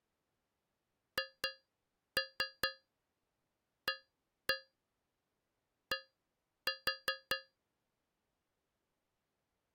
Tap code, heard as taps on a metal pipe, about 4 knocks a second. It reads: HAD